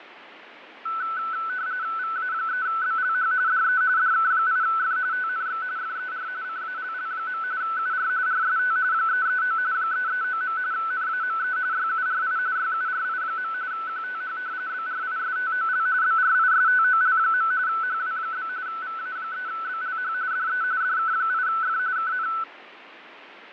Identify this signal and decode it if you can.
RTTY (45.45 baud, 170 Hz shift), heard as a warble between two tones, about 1410 Hz centre, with radio static and fading. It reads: VA3BLH DE DK8F TNX FER CALL. UR RST 339 339. NAME YURI YURI. QTH BRISTOL BRISTOL. HW? VA3BLH DE DK8F KN